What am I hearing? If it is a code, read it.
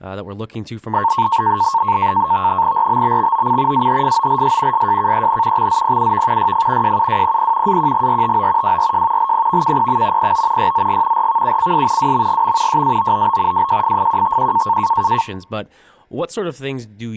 NAVTEX (SITOR-B), 100 baud, 170 Hz shift, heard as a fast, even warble, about 1000 Hz centre, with speech in English. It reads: RBBXOC AHFOLS SJKEN XZPUV YF JUWPP AQGRTO WRJ LPVKPM PO YZG RVUCS WMGM JAOOB WJFFQTQ